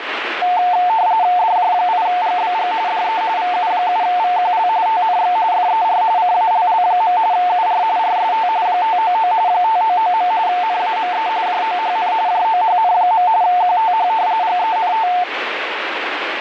RTTY (45.45 baud, 170 Hz shift), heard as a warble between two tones, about 800 Hz centre, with radio static. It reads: DJ8GBG DE VU7VQL TNX FER CALL. UR RST 599 599. NAME JOHN JOHN. QTH GENT